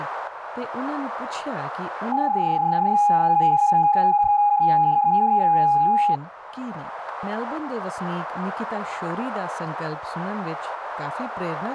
PSK31 (31.25 baud), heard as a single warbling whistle, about 820 Hz.